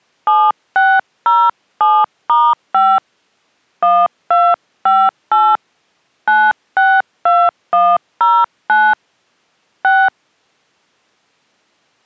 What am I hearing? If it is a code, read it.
DTMF, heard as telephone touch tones, dialled by hand, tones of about 240 ms. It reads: 7607*5 1258 962109 6